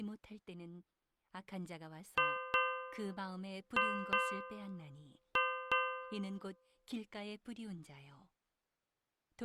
Ship's bell, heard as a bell, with speech in Korean. 6. Six half-hours of the watch have passed.